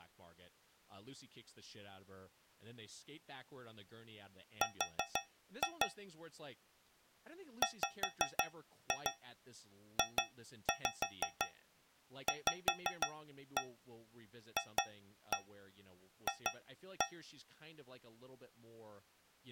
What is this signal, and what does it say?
Tap code, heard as taps on a metal pipe, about 5 knocks a second, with speech in English. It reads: R WJVFF